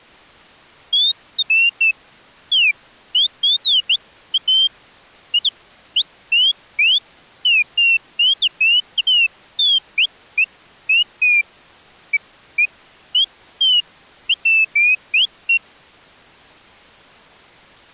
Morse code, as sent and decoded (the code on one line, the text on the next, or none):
none